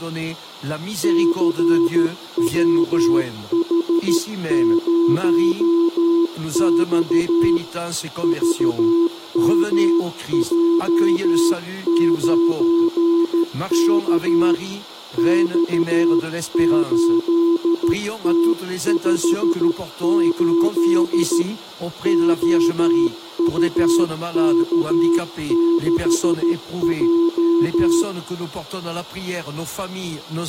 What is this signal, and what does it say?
Morse code, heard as a keyed tone, hand-sent with a paddle, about 13 wpm, 340 Hz, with room echo. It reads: CWH0X VMJ9K X8T58 OUK6J